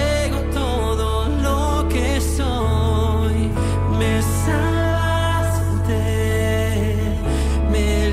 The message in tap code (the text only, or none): none